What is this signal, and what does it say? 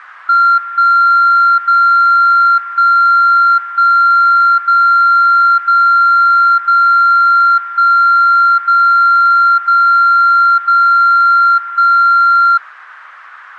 Radio time signal (DCF77), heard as a tone whose level steps once a second, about 1380 Hz. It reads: 1 0 1 1 0 0 0 1 0 0 0 1